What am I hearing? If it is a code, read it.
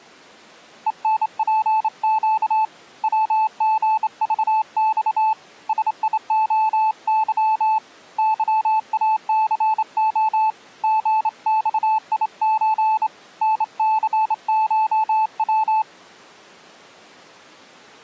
Morse code (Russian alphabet), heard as a keyed tone, hand-sent with a straight key, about 27 wpm, 870 Hz. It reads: ЕНПЩ ВГЖЬ СИОЫ ЫАЦО ГЬИЧ НЦШВ